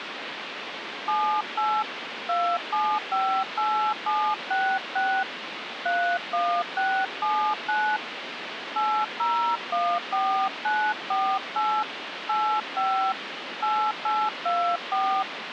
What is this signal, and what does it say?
DTMF, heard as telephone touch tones, dialled by hand, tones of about 300 ms, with phone line noise. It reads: 78 2758766 31679 8014948 85 8824